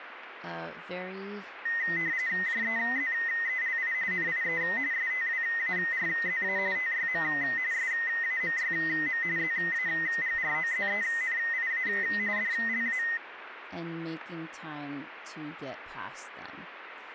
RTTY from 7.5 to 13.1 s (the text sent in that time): SAMYM ZAGROZENIA DLA